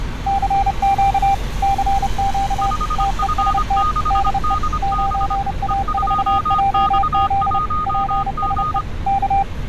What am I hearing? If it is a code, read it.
Morse code, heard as two keyed tones, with street noise. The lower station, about 30 wpm, 790 Hz: CQ CQ TEST DE 9A4JZ PSE K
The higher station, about 25 wpm, 1240 Hz: 5F6DB E2X1G